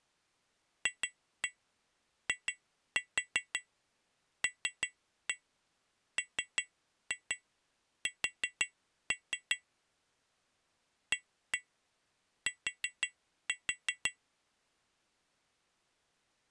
Tap code, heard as taps on glass, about 5 knocks a second. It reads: FILMS AT